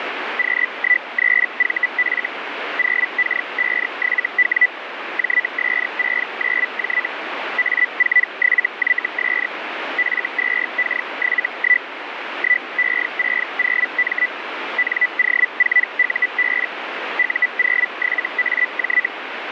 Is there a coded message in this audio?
Yes: Hellschreiber (Feld-Hell, 122.5 baud) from 0.4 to 19.1 s, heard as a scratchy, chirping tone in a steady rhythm, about 2000 Hz, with radio static. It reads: Q13VF 0K57W JS69J A47YS F2K71 1E60M NO4UB U07AJ